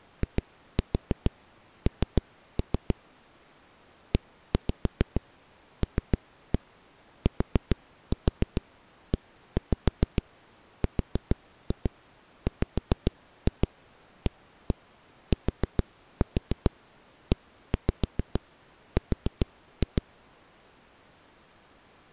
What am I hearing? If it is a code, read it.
Tap code, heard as knocks on a wall, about 6 knocks a second. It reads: IN ELTERWATER